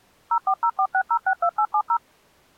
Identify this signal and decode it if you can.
DTMF, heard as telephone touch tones, dialled by machine, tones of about 70 ms. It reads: 04046062870